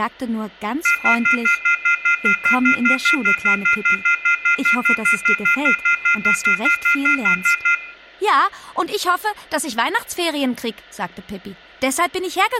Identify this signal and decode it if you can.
Telephone call progress tone (North American plan), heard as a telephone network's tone, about 1400, 2050, 2450, 2600 Hz, 0.1 s on and 0.1 s off, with room echo. Off-hook warning tone.